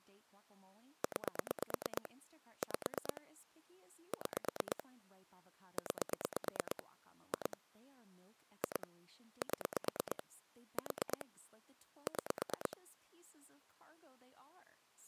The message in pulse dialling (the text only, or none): 9 5 6 9 2 2 7 4 6